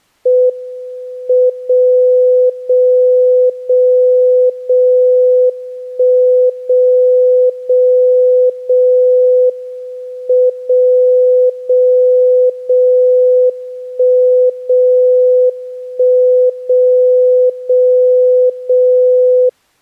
Radio time signal (WWVB), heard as a tone whose level steps once a second, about 500 Hz. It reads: M 0 0 0 0 1 0 0 0 M 0 0 0 1 0 1 0 0 0